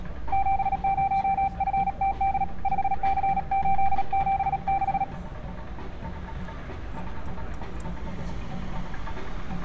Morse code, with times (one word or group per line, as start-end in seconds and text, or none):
0.3-2.4 70FTD
2.7-5.0 5C876